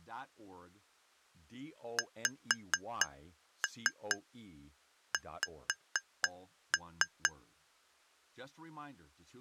Tap code, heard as taps on glass, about 4 knocks a second, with speech in English. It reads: XX